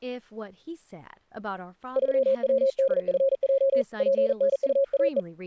Morse code, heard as a keyed tone, hand-sent with a paddle, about 40 wpm, 540 Hz, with speech in English. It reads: 3WDFJ PNUAE